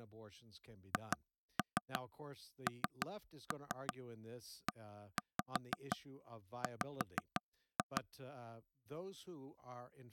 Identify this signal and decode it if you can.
Tap code, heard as taps on a table, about 5 knocks a second, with speech in English. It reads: HNEW